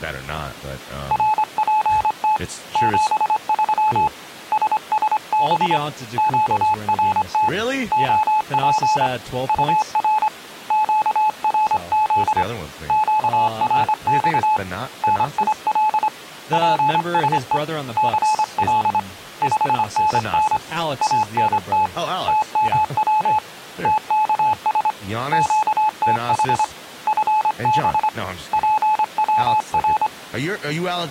Morse code, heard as a keyed tone, hand-sent with a straight key, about 25 wpm, 860 Hz, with speech in English. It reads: RPT 73 SSB QRT OP UR QRZ QRX NIL PSE CL 5NN ANT TMW TKS QTH FB PWR